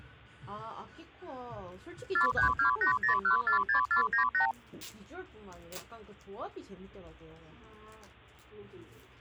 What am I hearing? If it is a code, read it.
Multi-frequency trunk signalling (R2, with the far end's replies), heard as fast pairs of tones, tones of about 110 ms, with the noise of a cafe. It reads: 43280146498